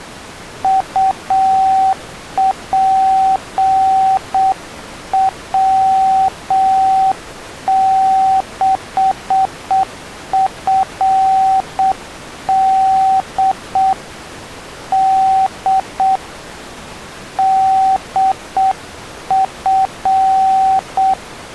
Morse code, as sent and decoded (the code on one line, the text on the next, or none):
..- .--. .-- -.... ..-. -.. / -.. / -.. ..-.
UPW6FD D DF